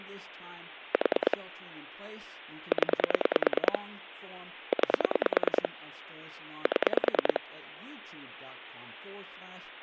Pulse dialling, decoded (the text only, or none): 4 0 9 7